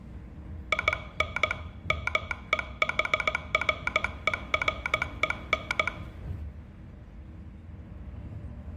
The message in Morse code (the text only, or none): IN MEHREREN